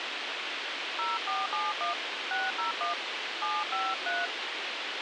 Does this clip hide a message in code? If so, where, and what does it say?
Yes: DTMF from 1.0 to 4.3 s, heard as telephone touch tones, dialled by hand, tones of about 180 ms, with radio hiss. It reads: 0471 601 753